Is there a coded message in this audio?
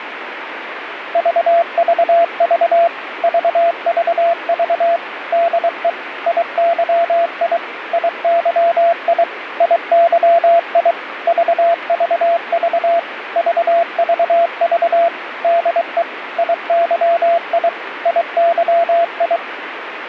Yes: Morse code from 1.1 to 19.4 s, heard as a keyed tone, machine-sent, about 23 wpm, 680 Hz, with radio static. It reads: VVV VVV DE IYI IYI IYI VVV VVV DE IYI IYI